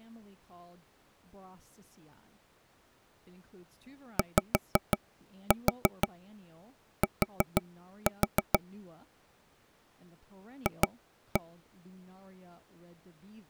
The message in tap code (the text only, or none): YT F